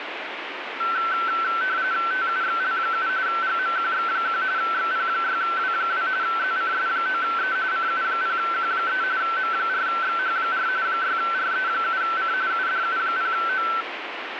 RTTY (45.45 baud, 170 Hz shift), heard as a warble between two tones, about 1440 Hz centre, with radio static. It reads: TUXL7 GMQX1 XP6W2 ZCS9E CU0Q3 M4XH4 6RE7C UDU0O